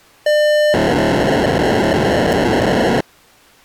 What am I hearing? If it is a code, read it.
POCSAG pager data (1200 baud), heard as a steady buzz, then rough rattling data.